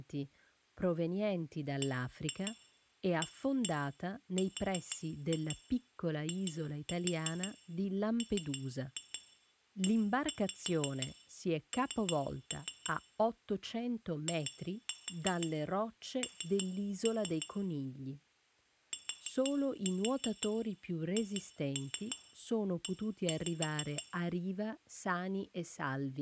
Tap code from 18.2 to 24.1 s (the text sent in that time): THE